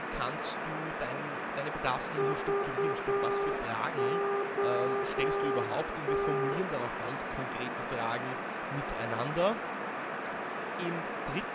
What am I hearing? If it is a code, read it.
Morse code, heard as a keyed tone, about 8 wpm, 400 Hz, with radio static, a narrow filter, room echo and speech in German. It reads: VOT